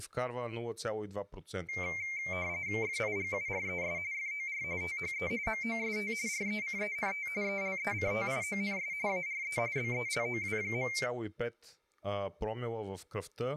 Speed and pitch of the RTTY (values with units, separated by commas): 45.45 baud, 170 Hz shift, 2200 Hz centre